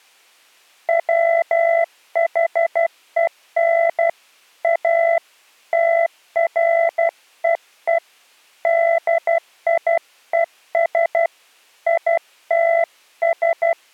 Morse code, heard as a keyed tone, hand-sent with a paddle, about 12 wpm, 670 Hz. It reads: WHEN A TREE DIES ITS